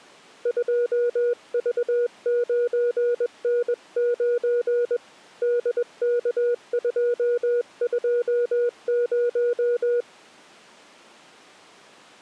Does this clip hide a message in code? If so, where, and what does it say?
Yes: Morse code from 0.4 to 10.1 s, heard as a keyed tone, hand-sent with a paddle, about 21 wpm, 480 Hz. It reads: 2V9N9 DK220